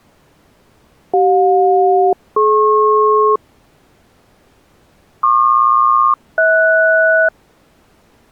Aircraft SELCAL, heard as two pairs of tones. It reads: CJ-DP PQ-HS